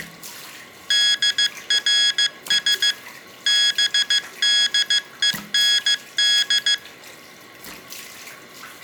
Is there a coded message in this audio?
Yes: Morse code (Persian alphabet) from 0.8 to 6.8 s, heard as electronic beeps, machine-sent, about 15 wpm, 1650 Hz, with room echo and the noise of a restroom. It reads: درس بدهند